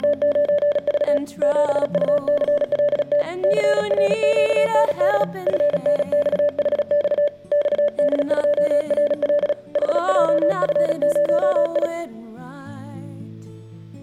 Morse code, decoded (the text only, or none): … 7UCLT CRQND FNXHX XD2RL HJF0I